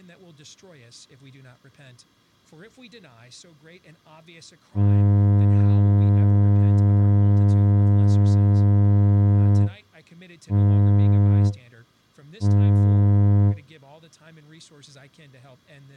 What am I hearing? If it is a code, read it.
Ship horn signal, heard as a ship's horn, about 100 Hz, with speech in English. 1 long, 2 short. At sea: a vessel in fog that is sailing, fishing, towing or hampered.